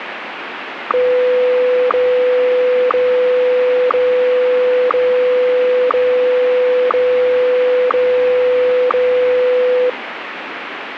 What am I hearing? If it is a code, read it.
Radio time signal (WWVH, Hawaii), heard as ticks, one a second, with radio static.